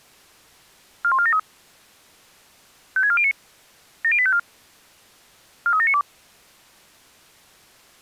Five-tone selective call (ZVEI), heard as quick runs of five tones, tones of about 70 ms. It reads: 41473 56409 70854 43792